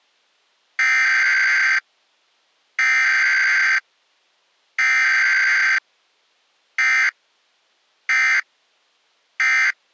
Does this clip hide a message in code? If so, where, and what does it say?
Yes: Emergency Alert System (SAME) tones (header bursts, then end-of-message bursts) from 0.8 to 9.7 s, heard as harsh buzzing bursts, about 520.83 baud.